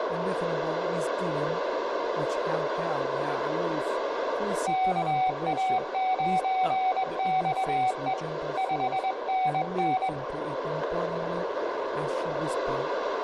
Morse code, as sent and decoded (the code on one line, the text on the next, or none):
-.- .- ----. -..- . / ..... -. -.
KA9XE 5NN